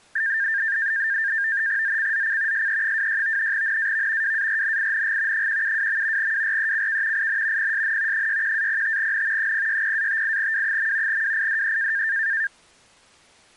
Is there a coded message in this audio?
Yes: NAVTEX (SITOR-B), 100 baud, 170 Hz shift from 0.2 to 12.5 s, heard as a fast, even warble, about 1700 Hz centre. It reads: ZCZC SE26 NAV WARNING 172. WRECK IN PSN 61-05N 060-58W. WIDE